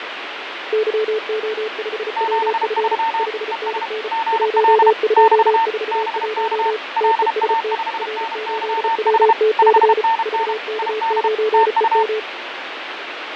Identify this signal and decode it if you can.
Morse code, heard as two keyed tones, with radio static and fading. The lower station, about 34 wpm, 430 Hz: YO5WF 5NN 1241 TEST R8WTC VK9EM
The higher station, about 32 wpm, 900 Hz: 73 ES GL <BT> BK LA5NYH 5NN ID TU